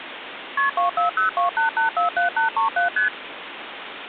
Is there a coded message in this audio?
Yes: multi-frequency trunk signalling (R1, as on North American trunks) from 0.6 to 3.1 s, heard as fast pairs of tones, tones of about 120 ms, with phone line noise. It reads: KP 24028847837 ST